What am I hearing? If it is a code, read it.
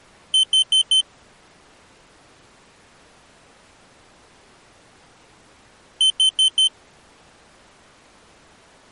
Alarm pattern, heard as an alarm's beeps, played twice, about 3100 Hz. Temporal four. Carbon monoxide.